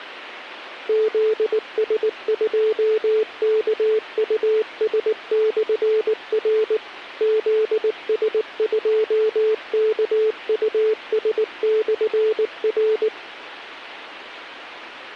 Morse code, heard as a keyed tone, machine-sent, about 19 wpm, 440 Hz, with radio hiss. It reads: ZS2KUS/R ZS2KUS/R